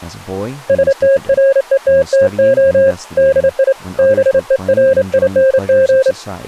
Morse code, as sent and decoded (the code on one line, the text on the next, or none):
... - .-. . - - --- / -.. .. / -... . .-. .. -. --.
STRETTO DI BERING